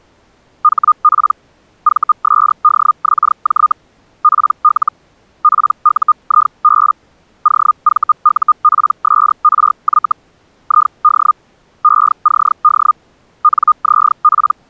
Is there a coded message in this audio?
Yes: Hellschreiber (Feld-Hell, 122.5 baud) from 0.6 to 14.5 s, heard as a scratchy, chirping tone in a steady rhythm, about 1220 Hz. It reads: HP VSDXJ PL PUIB OVUPSRY ID ECD NZP